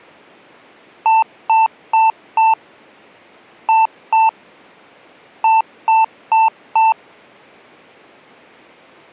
Beep code, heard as beeps, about 890 Hz. 4-2-4. In Phoenix BIOS tables: unexpected interrupt in protected mode.